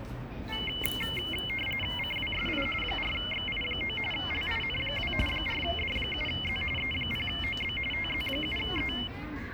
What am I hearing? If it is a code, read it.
RTTY (45.45 baud, 850 Hz shift), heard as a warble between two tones, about 2550 Hz centre, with the noise of a park. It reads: CWSI 4XI9 LIN2 4D7Z E0OB TZ7E